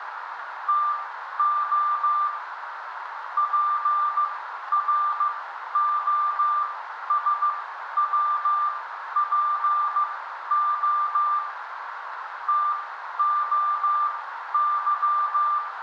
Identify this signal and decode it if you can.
Morse code (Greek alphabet), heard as a keyed tone, machine-sent, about 15 wpm, spaced as for 11 wpm, 1190 Hz, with radio static, a narrow filter and room echo. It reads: ΤΟ ΠΡΟΣΩΠΟ ΤΟΥ